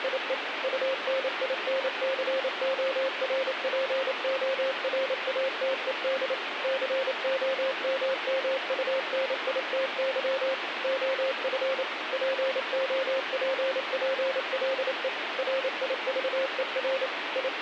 Morse code, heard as a keyed tone, machine-sent, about 28 wpm, 530 Hz, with radio static. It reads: … UNINCORPORATED COMMUNITY OF POPPLE RIVER …